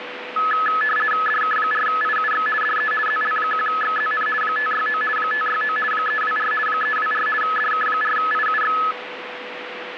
RTTY (50 baud, 450 Hz shift), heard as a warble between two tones, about 1500 Hz centre, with radio static and a steady whistle near 490 Hz. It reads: DK4IUX DE ZL1XZN 569 569 324 324 DK4IUX